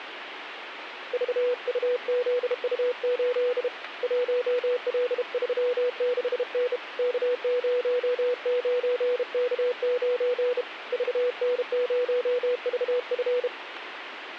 Morse code, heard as a keyed tone, hand-sent with a bug key, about 32 wpm, 490 Hz, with radio static. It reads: VUZU8 1L36N K09K9 VN0VF